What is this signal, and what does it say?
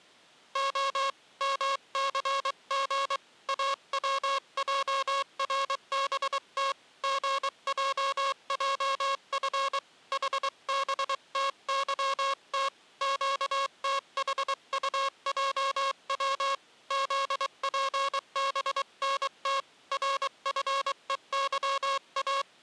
Morse code, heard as a buzzer, hand-sent with a paddle, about 23 wpm. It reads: O MCG AWJRBT GJJF HBTYT QTHUJW ZPBNT RFEYA